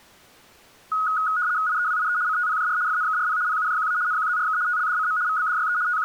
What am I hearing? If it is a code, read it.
RTTY (75 baud, 170 Hz shift), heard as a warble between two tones, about 1360 Hz centre. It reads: IEWIE CTPJR FNKRP PUJQA NQZRK TLDCM VBDYE …